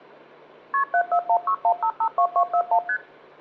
Multi-frequency trunk signalling (R1, as on North American trunks), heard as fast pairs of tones, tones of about 80 ms. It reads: KP 74161552241 ST